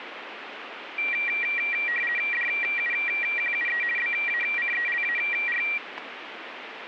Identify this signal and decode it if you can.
RTTY (50 baud, 450 Hz shift), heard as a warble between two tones, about 2150 Hz centre, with radio static. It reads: DUQUE BACELAR